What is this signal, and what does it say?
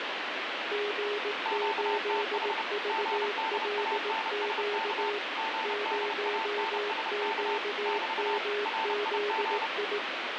Morse code, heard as two keyed tones, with heavy radio static. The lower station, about 18 wpm, 410 Hz: G8VLQ 0QMZI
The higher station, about 30 wpm, 890 Hz: QTH GDANSK GDANSK <BT> RIG